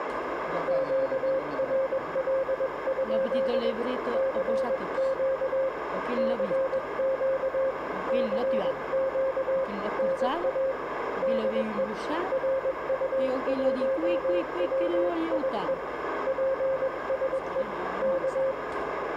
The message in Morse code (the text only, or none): QRL? CQ CQ CQ NA DE RU1WIE PSE K